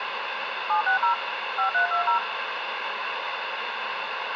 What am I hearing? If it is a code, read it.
DTMF, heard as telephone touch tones, dialled by machine, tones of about 110 ms, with radio hiss and room echo. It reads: 760 5320